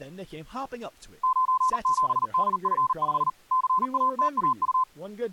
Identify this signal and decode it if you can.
Morse code, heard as a keyed tone, machine-sent, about 39 wpm, 1030 Hz, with speech in English. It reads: 97DF5 CATAU